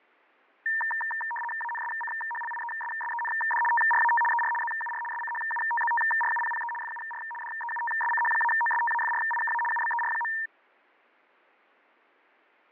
RTTY (75 baud, 850 Hz shift), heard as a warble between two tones, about 1370 Hz centre, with fading. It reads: ANSCHLIESSEND TRAT ER ZUR SCHUTZTRUPPE FUR DEUTSCH-OSTAFRIKA UBER.